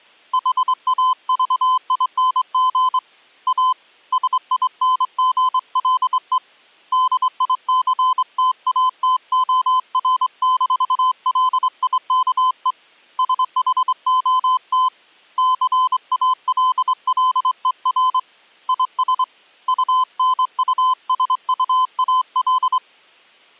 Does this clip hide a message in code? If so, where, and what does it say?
Yes: Morse code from 0.3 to 22.8 s, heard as a keyed tone, hand-sent with a straight key, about 24 wpm, 1020 Hz. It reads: HAVING A SINGLE DICTATOR-LIKE SHOT CALLER IS UNUSUAL